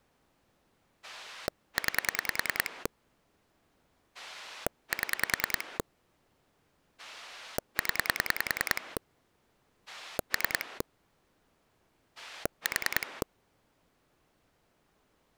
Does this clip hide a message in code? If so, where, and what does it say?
Yes: pulse dialling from 1.0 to 13.2 s, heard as a rotary dial, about 10 pulses a second. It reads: 9 7 0 3 4